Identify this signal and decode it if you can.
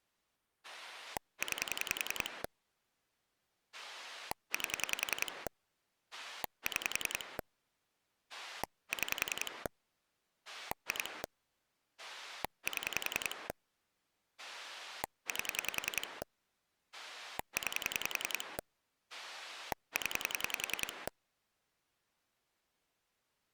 Pulse dialling, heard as a rotary dial, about 10 pulses a second. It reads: 9 8 6 6 2 7 8 9 0